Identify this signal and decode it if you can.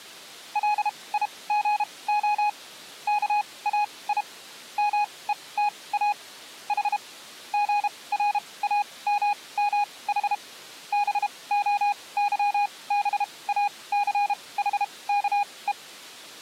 Morse code (Greek alphabet), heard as a keyed tone, machine-sent, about 32 wpm, spaced as for 22 wpm, 830 Hz. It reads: ΛΙΓΟ ΚΑΙ ΜΕΤΑ Η ΓΡΑΜΜΗ ΒΟΥΒΑΘΗΚΕ